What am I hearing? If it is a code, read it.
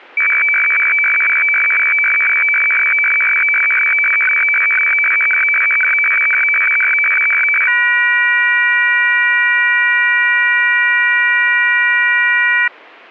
Weather fax (radiofax), 120 lines a minute, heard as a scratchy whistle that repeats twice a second.